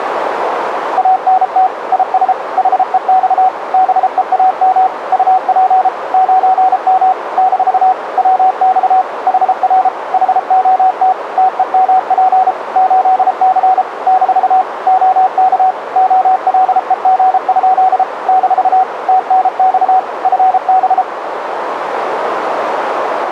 Morse code, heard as a keyed tone, machine-sent, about 33 wpm, 750 Hz, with radio static and a narrow filter. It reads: ANT IS HEX BEAM UP 9M - WX HR HOT TEMP 8C - OK OLEG? - TNX FB